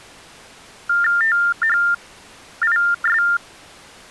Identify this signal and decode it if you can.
TTY/TDD text telephone tones (45.45 baud Baudot), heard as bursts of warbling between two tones, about 400 Hz shift, 1600 Hz centre. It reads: THIS